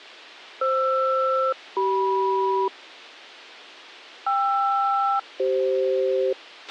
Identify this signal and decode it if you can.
Aircraft SELCAL, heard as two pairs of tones, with a squelch burst at the end. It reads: FR-CM KR-CF